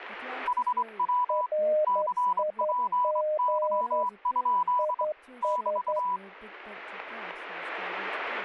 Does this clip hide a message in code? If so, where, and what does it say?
Yes: Morse code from 0.4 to 6.2 s, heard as two keyed tones, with speech in English. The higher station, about 23 wpm, 990 Hz: HW CPY? <BT>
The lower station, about 11 wpm, 610 Hz: RIG IS